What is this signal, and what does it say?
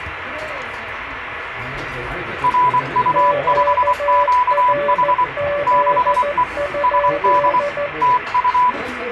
Morse code, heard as two keyed tones, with radio static and the noise of a restaurant. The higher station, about 24 wpm, 990 Hz: RU5QH 6E SD TU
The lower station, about 14 wpm, 580 Hz: QRZ?